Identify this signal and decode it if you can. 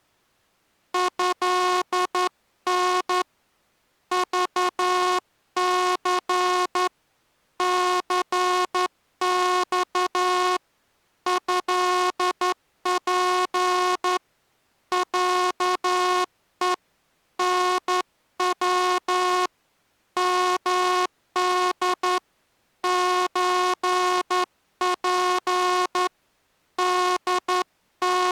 Morse code (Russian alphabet), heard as a buzzer, hand-sent with a straight key, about 11 wpm. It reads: ЭН ЖЦ ЦЬ ЭП ЯЕ НВ МД ЧП …